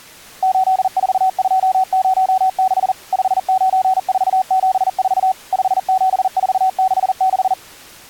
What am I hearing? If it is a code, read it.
Morse code, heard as a keyed tone, machine-sent, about 40 wpm, 760 Hz. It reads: 84206 59474 57466